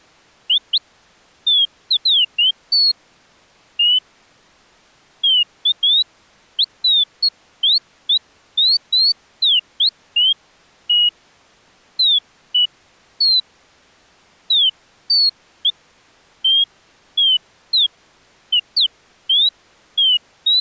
Bird-like chirps. There is no code.